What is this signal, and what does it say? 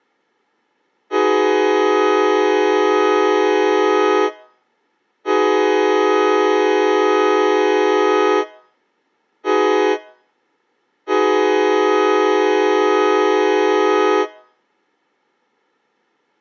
Train horn signal, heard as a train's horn. 2 long, 1 short, 1 long. On North American railways: approaching a public crossing.